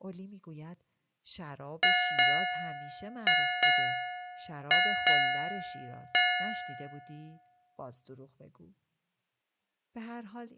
Ship's bell, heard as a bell, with speech in Persian. 7. Seven half-hours of the watch have passed.